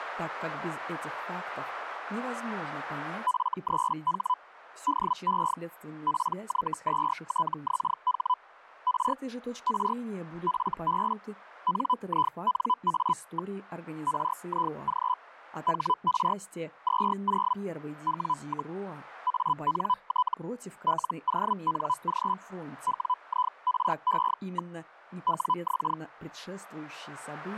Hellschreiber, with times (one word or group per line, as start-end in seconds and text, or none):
3.3-4.3 F3H
4.9-5.5 DE
6.1-8.3 PY2TXH
8.9-9.1 R
9.7-9.9 R
10.5-11.1 FB
11.7-13.5 NINA.
14.1-15.1 RIG
15.7-16.3 HR
16.9-17.5 20
18.1-18.7 W,
19.3-20.3 ANT
20.9-22.3 LONG
22.9-24.7 WIRE.
25.3-25.9 WX